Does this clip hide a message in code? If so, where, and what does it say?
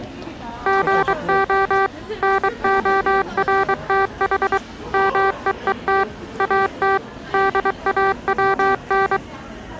Yes: Morse code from 0.6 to 9.2 s, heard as electronic beeps, machine-sent, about 23 wpm, 390 Hz, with the noise of a crowd indoors. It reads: GO NORTH MEET AT DAWN